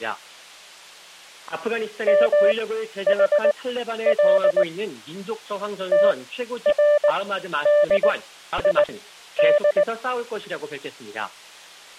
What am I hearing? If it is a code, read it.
Morse code (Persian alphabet), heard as a keyed tone, machine-sent, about 19 wpm, spaced as for 11 wpm, 590 Hz. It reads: محل تردید